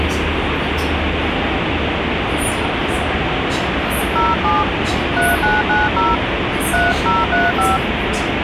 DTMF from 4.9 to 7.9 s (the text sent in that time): 3990 3035